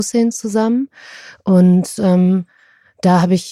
Speech in German. There is no code.